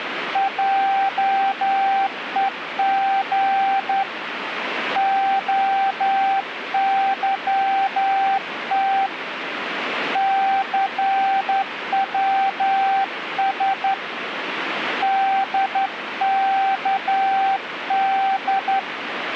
Morse code, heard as a keyed tone, hand-sent with a straight key, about 11 wpm, 780 Hz, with radio static. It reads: JEG OYT CWS DKD